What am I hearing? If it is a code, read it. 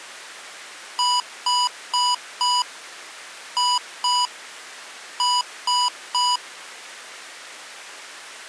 Beep code, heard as beeps from a small speaker, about 980 Hz. 4-2-3. In Phoenix BIOS tables: gate A20 failure.